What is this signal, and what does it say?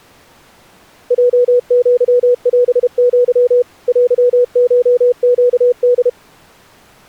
Morse code (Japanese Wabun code), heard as a keyed tone, machine-sent, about 32 wpm, 490 Hz. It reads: ヲアオア テコネホ